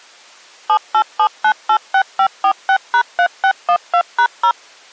DTMF, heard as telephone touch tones, dialled by machine, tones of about 80 ms. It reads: 787986546#3612#0